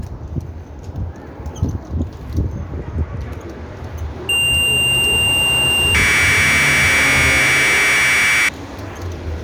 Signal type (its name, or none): Commodore tape loading